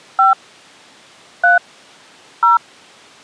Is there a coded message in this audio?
Yes: DTMF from 0.2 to 2.6 s, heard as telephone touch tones, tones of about 140 ms. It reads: 5 3 0